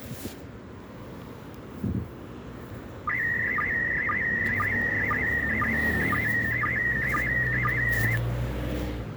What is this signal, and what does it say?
SSTV (slow-scan television), PD 120, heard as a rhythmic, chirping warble, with the noise of a residential street.